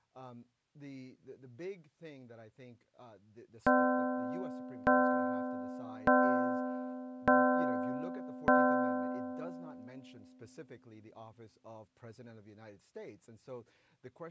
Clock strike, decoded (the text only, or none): 5